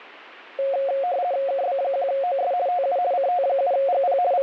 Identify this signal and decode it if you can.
RTTY (50 baud, 170 Hz shift), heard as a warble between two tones, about 630 Hz centre, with radio static. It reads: KB1OS TU CT7GP …